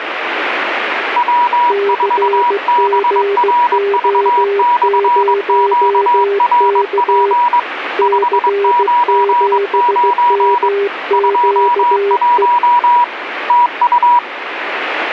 Morse code, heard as two keyed tones, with radio static. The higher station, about 22 wpm, 970 Hz: W4BRV/QRP 599 21 TU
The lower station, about 16 wpm, 400 Hz: CGO0K C7MQE